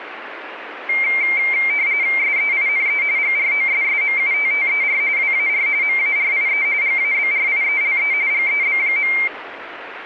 RTTY (45.45 baud, 170 Hz shift), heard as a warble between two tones, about 2200 Hz centre, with radio static. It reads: SEINE GROSSMUTTER WAR MARIE GABRIELE GEB.